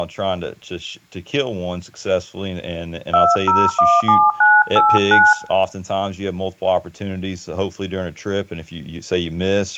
DTMF, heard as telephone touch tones, dialled by hand, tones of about 220 ms, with room echo and speech in English. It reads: 2017989